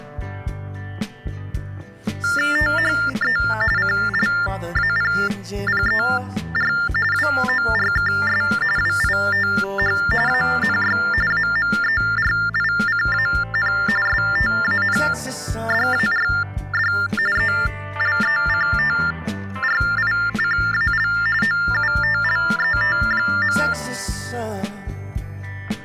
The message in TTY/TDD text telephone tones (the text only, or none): THE CLAPPER WORKS WITH ANY AMERICAN STANDARD ELECTRICAL OUTLET.